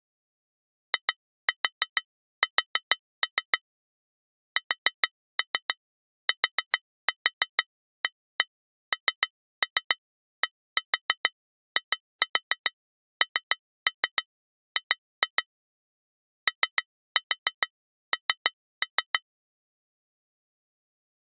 Tap code, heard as taps on glass, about 6 knocks a second. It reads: IS STANDING ON